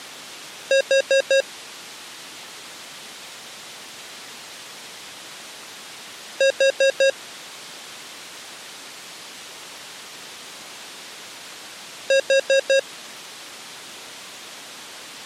Alarm pattern, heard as an alarm's beeps, played three times, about 540 Hz. Temporal four. Carbon monoxide.